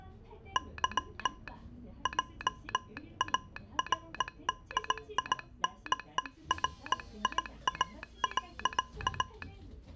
Morse code, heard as a telegraph sounder, hand-sent with a paddle, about 18 wpm, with the noise inside a bus. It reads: Y JARDINERIA.